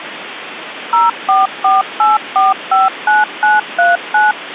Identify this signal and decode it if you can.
DTMF, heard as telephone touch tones, dialled by machine, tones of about 170 ms, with phone line noise. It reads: 0448459939